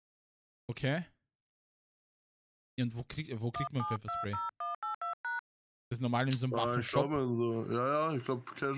DTMF, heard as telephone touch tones, dialled by hand, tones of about 170 ms, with speech in German. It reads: 1720182#